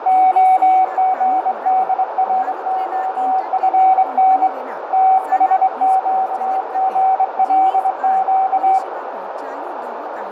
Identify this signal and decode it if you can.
Morse code, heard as a keyed tone, hand-sent with a straight key, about 24 wpm, 760 Hz, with heavy radio static, fading, a narrow filter, room echo and speech in Santali. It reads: OGDROFN THQGLQ